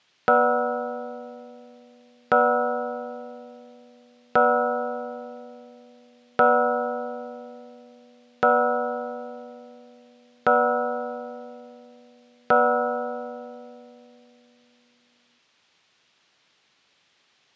Clock strike, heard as a bell. 7. Seven o'clock.